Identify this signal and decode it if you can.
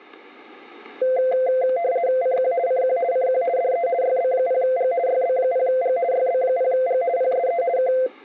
RTTY (50 baud, 170 Hz shift), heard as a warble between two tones, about 600 Hz centre, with static crashes. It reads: CQ CQ CQ DE YB0G YB0G YB0G PSE K